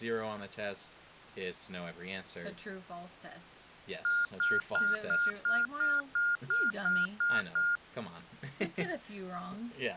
Beep code, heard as beeps, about 1420 Hz, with speech in English. 11 short. In AMI BIOS tables: cache memory error.